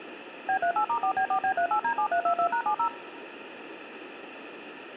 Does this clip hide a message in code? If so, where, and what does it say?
Yes: DTMF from 0.5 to 2.9 s, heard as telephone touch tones, dialled by machine, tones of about 90 ms, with phone line noise. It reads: B38*4B4B38D7322#70